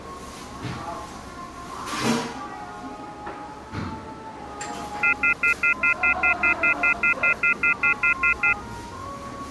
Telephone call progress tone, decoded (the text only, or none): off-hook warning tone